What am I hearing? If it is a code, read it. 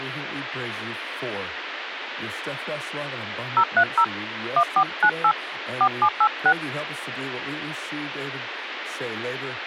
DTMF, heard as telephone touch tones, dialled by hand, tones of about 70 ms, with phone line noise and speech in English. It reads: 030 1498 4786